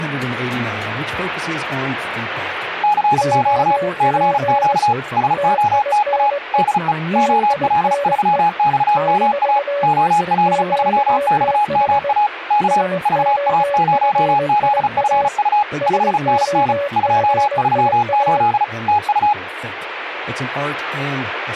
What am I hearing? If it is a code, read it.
Morse code, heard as two keyed tones. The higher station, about 35 wpm, 840 Hz: CQ CQ SOTA DE OL3XMA OL3XMA K VA0ZFU 5NN 238 TU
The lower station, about 21 wpm, 570 Hz: OP TINE TINE - QTH SOFIA SOFIA